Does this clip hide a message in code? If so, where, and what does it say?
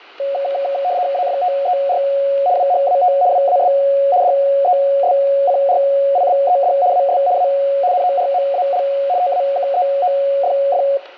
Yes: RTTY (75 baud, 170 Hz shift) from 0.2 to 11.0 s, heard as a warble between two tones, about 640 Hz centre, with room echo. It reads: AFTER WHAT WAS DESCRIBED AS A NORMAL TAKEOFF